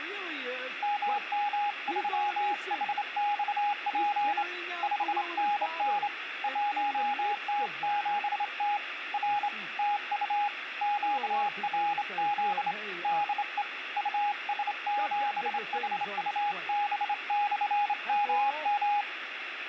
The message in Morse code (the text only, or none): MM3HXP 5NN 1T7T R TU QRZ DE US7HUB/MM